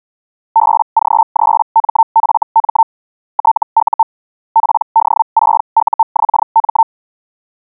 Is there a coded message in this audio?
Yes: Hellschreiber (Feld-Hell, 122.5 baud) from 0.6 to 6.8 s, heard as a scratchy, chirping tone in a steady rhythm, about 900 Hz. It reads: BG3MFM TU PD6UXM